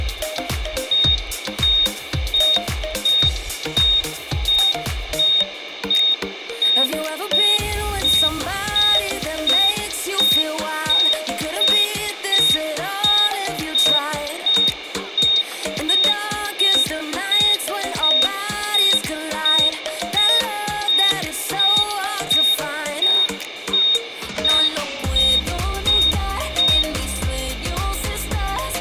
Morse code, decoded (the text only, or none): none